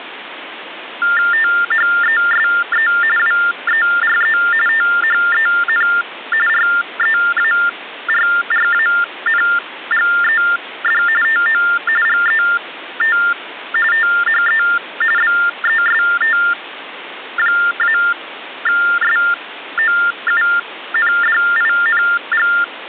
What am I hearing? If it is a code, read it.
TTY/TDD text telephone tones (45.45 baud Baudot), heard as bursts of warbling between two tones, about 400 Hz shift, 1600 Hz centre, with phone line noise. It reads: THESE WERE THEN REARRANGED TO GET THE BEST-SOUNDING